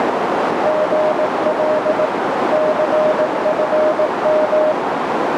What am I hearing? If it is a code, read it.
Morse code, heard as a keyed tone, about 18 wpm, 620 Hz, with heavy radio static and a narrow filter. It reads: GL CFM